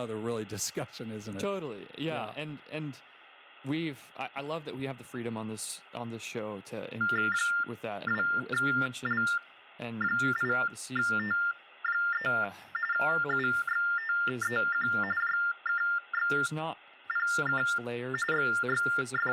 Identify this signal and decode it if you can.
TTY/TDD text telephone tones (45.45 baud Baudot), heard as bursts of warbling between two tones, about 400 Hz shift, 1600 Hz centre, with speech in English. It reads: 2L8T3 UXTEQ JKXPK …